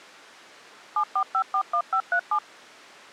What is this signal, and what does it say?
DTMF, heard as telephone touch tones, dialled by machine, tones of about 80 ms. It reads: 74541537